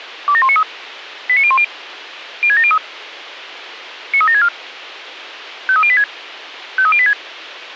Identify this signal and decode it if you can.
Five-tone selective call (ZVEI), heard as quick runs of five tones, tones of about 70 ms, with radio hiss. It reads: 27193 89010 06703 93764 53086 53086